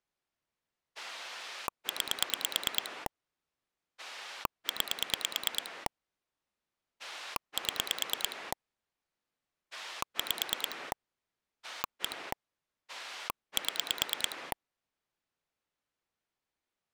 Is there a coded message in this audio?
Yes: pulse dialling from 1.0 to 14.5 s, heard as a rotary dial, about 9 pulses a second. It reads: 9 9 7 5 1 7